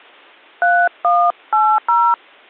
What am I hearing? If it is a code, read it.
DTMF, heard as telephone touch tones, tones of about 260 ms. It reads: 3180